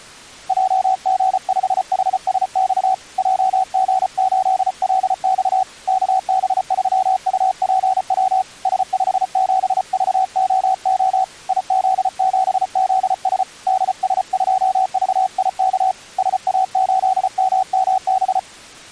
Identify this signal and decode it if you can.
Morse code, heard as a keyed tone, hand-sent with a paddle, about 34 wpm, 760 Hz. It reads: JG5HSX JG8LX KB3UPW S57VOO IZ7ZS DS2VIK SA8MMB